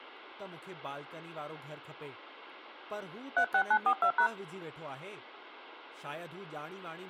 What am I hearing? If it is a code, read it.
DTMF, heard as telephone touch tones, dialled by hand, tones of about 80 ms, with speech in Sindhi. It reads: 36942#